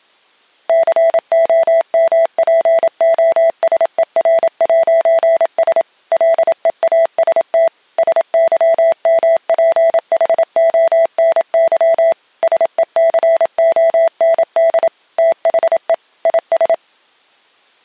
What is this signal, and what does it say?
Morse code, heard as a keyed tone, machine-sent, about 27 wpm, 660 Hz. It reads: COMPOSER'S LEAST SYMPHONY SECOND THE IS